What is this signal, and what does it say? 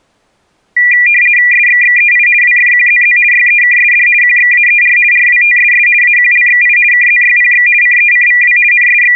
RTTY (50 baud, 450 Hz shift), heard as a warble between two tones, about 2200 Hz centre. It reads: SXXEI WFQZZ YEKSD QXAER RWTSS AQLXI KZYPX CECVW …